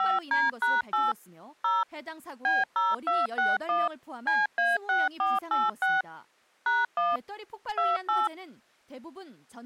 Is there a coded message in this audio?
Yes: DTMF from 0.0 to 8.3 s, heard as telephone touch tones, dialled by machine, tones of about 190 ms, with speech in Korean. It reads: 5D#8 0 B0261 CA6486 #1 28